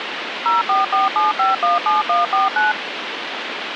DTMF, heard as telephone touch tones, dialled by machine, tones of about 160 ms, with phone line noise. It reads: 0447517149